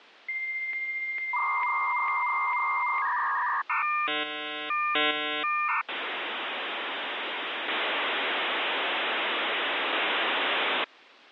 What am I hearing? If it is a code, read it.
Dial-up modem handshake (V.34 or later), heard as a whistle, warbles, then hiss.